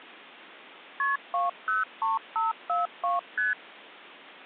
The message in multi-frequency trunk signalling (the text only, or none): KP 203542 ST